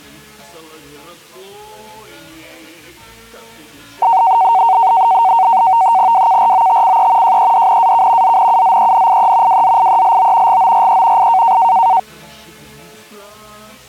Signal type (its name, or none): NAVTEX (SITOR-B)